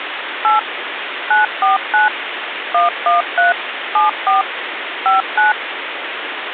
DTMF, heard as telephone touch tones, dialled by machine, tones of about 140 ms, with phone line noise. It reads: 8 949 113 74 59